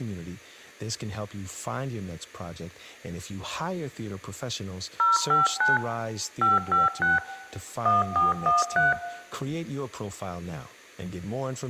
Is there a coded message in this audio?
Yes: DTMF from 5.0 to 8.9 s, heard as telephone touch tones, dialled by machine, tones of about 160 ms, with room echo and speech in English. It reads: 059 556 1413